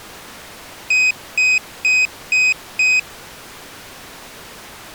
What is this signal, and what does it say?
Beep code, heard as a piezo beeper, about 2500 Hz. 5 short. In AMI BIOS tables: processor failure; in Dell tables: CMOS battery failure.